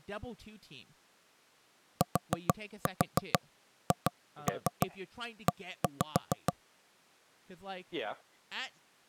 Tap code, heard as knocks on wood, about 6 knocks a second, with speech in English. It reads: THE